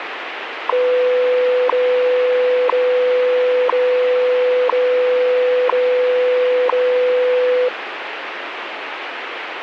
Radio time signal (WWV, Colorado), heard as ticks, one a second, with radio static.